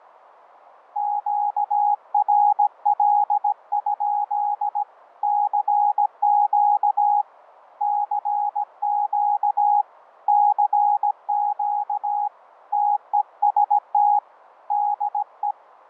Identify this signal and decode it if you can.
Morse code, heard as a keyed tone, hand-sent with a paddle, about 17 wpm, 830 Hz. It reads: QRL? CQ CQ CQ TEST DE